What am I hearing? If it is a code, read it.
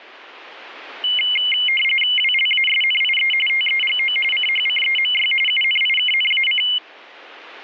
RTTY (45.45 baud, 850 Hz shift), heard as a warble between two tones, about 2550 Hz centre. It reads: WLASNIE TEGO CHCEMY UNIKNAC